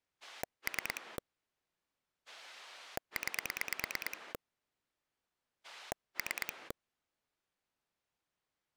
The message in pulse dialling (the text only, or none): 3 9 3